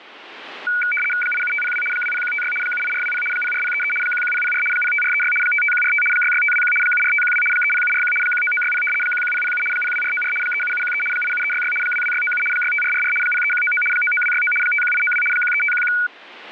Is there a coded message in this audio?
Yes: RTTY (75 baud, 850 Hz shift) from 0.7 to 16.1 s, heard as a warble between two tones, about 1900 Hz centre, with radio static. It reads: 87502 20156 78420 04033 11004 05436 55145 66521 74512 30741 19960 11007 02494 37713 87366 22697 65444 03199 99269 51892 13511